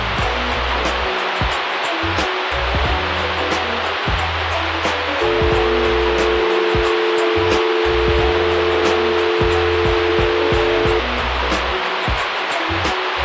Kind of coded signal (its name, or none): telephone call progress tone